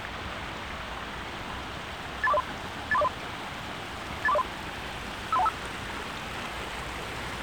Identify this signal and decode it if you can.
Five-tone selective call (EIA), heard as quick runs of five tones, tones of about 30 ms, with the noise of a park. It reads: 83403 83403 83403 53125